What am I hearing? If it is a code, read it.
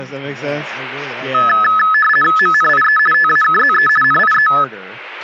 RTTY (50 baud, 450 Hz shift), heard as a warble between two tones, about 1500 Hz centre, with speech in English. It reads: MNIE TAKZE NIE